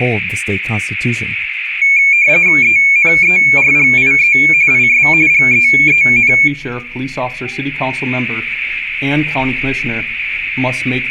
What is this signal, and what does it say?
RTTY (45.45 baud, 170 Hz shift), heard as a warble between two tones, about 2300 Hz centre. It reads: ENERGIE IS GEEN